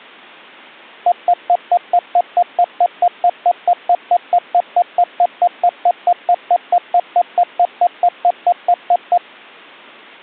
Evenly repeated beeps. There is no code.